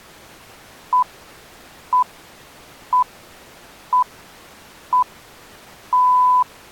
Radio time signal (six pips, as the Greenwich Time Signal), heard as pips.